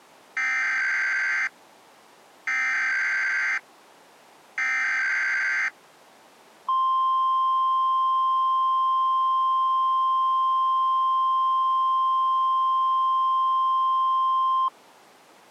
Emergency Alert System (SAME) tones (header bursts, then the 1050 Hz attention tone), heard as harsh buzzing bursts, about 520.83 baud.